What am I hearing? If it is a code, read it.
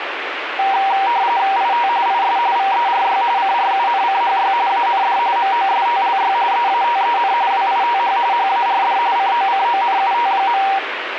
RTTY (45.45 baud, 170 Hz shift), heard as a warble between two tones, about 860 Hz centre, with radio static. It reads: IT IS VERY CRUNCHY AND MOSTLY EATEN WITH HARD COCONUT.